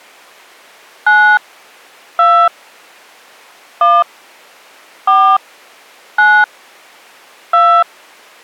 DTMF, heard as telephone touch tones, dialled by hand, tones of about 270 ms. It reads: 9 2 1 4 9 2